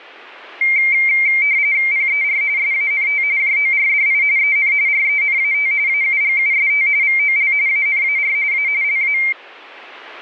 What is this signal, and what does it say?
RTTY (45.45 baud, 170 Hz shift), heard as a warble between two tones, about 2200 Hz centre. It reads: PER SANT JORDI EN RENAT AUGUST VOL ANAR A LA